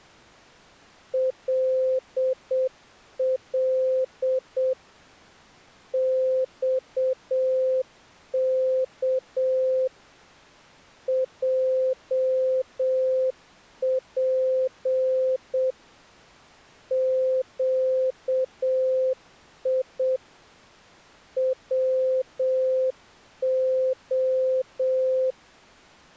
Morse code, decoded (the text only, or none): LL XK JP QI WO